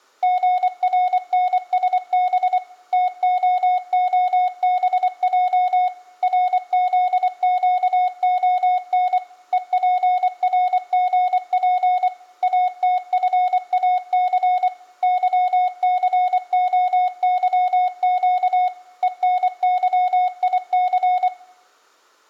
Morse code, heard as a keyed tone, machine-sent, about 24 wpm, 730 Hz, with room echo. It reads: GRNSB TOOBJ RZQON EPRGP ATFAC YCOYQ ENYIC